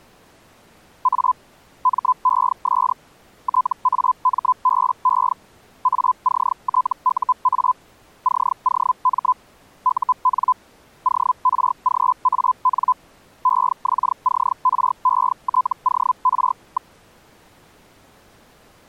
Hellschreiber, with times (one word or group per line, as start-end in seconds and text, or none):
1.0-1.3 A
1.8-2.9 MES
3.4-5.3 TAMBE
5.8-7.7 ACTUA
8.2-9.3 COM
9.8-10.5 UN
11.0-12.9 ORGAN
13.4-16.9 EXCRETOR.